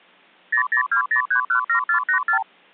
Multi-frequency trunk signalling (R2, with the far end's replies), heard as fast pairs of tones, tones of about 100 ms. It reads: 0020317484